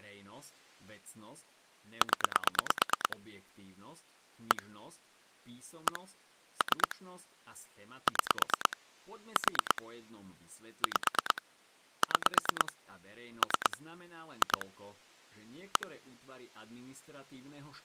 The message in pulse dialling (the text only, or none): 0 1 1 3 6 4 5 6 3 2 1